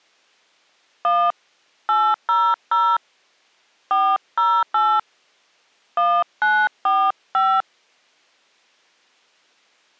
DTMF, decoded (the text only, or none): 1 800 408 1945